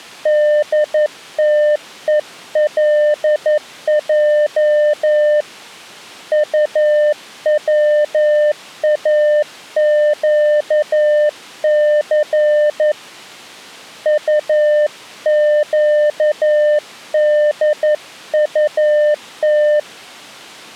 Morse code, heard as a keyed tone, hand-sent with a paddle, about 11 wpm, 600 Hz. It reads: DTELJ UWAQC UQDUT